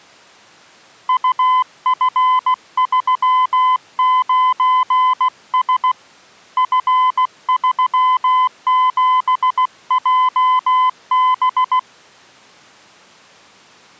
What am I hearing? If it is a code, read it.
Morse code, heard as a keyed tone, hand-sent with a paddle, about 16 wpm, 1020 Hz. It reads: UF39S F37JB